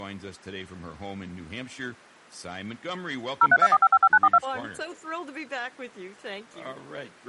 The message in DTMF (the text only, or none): 0324555942